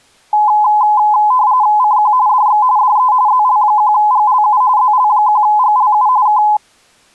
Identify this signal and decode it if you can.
RTTY (45.45 baud, 170 Hz shift), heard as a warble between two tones, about 930 Hz centre. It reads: CQ DX DE ZL1GLU ZL1GLU K